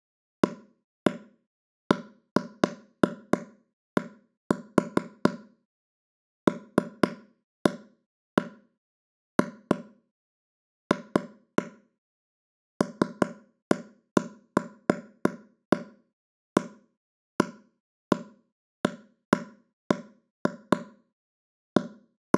Irregular taps on a table. There is no code.